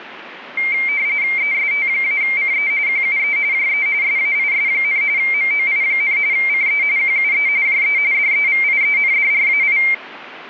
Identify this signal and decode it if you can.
RTTY (45.45 baud, 170 Hz shift), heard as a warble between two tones, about 2200 Hz centre, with radio static. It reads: EST-CE QUE JE SAIS, MOI, CE QUE JE DEVIENDRAI